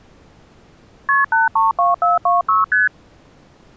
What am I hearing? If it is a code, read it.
Multi-frequency trunk signalling (R1, as on North American trunks), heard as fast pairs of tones, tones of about 160 ms. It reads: KP 832426 ST